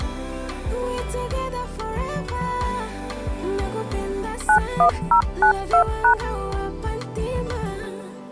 DTMF, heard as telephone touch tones, dialled by machine, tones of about 90 ms. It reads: 91092#